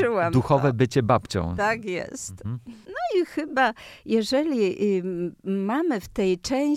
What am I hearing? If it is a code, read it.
Speech in Polish. There is no code.